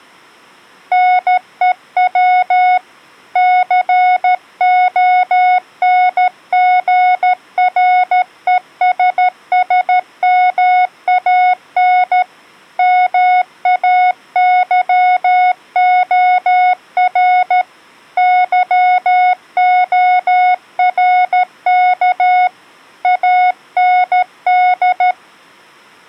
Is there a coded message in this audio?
Yes: Morse code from 0.9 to 25.2 s, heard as a keyed tone, hand-sent with a paddle, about 13 wpm, 730 Hz. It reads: NEW CONGRESSMAN MAYOR YORK AND